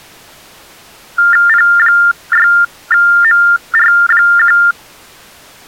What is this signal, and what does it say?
TTY/TDD text telephone tones (45.45 baud Baudot), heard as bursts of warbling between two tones, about 400 Hz shift, 1600 Hz centre. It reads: P6MR1